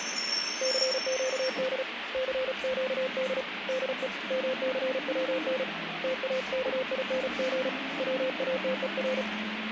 Morse code, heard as a keyed tone, hand-sent with a paddle, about 35 wpm, 520 Hz, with radio static and the noise inside a bus. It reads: CQD CQD DE MCWN TAKING WATER